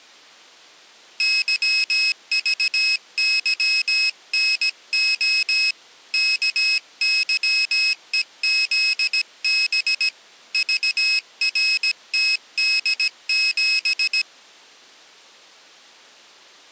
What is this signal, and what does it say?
Morse code, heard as a high beeper, hand-sent with a paddle, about 17 wpm, 2550 Hz. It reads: YVYNO KYEZB VRTD7